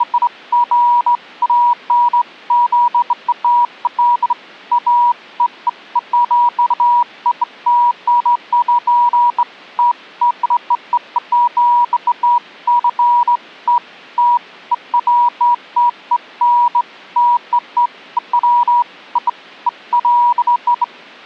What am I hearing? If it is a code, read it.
Beeps of irregular length. There is no code.